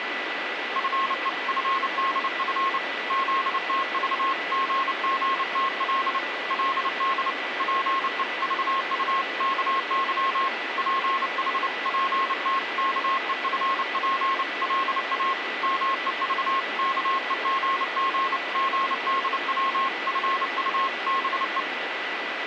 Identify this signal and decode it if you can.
Morse code (Korean alphabet), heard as a keyed tone, hand-sent with a paddle, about 29 wpm, 1080 Hz, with radio static and a steady whistle near 1980 Hz. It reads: 나는 털썩 그 자리에 주저앉고 말았습니다